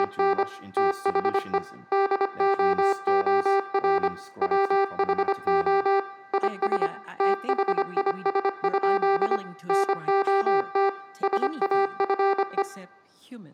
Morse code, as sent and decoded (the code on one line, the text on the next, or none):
… / - .... . / -.. --- --- .-. / .-- .... --- / .. ... / - .... .. ... ..--.. / -. --- - / ... .- ..-. .
… THE DOOR WHO IS THIS? NOT SAFE